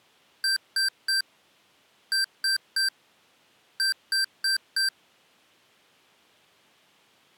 Beep code, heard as beeps from a small speaker, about 1550 Hz. 3-3-4. In Phoenix BIOS tables: video failure.